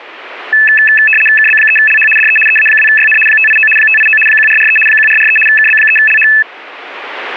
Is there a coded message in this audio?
Yes: RTTY (75 baud, 850 Hz shift) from 0.5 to 6.4 s, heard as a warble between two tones, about 2150 Hz centre. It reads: KB3LH DE EA2YN 589 589 1443 1443 KB3LH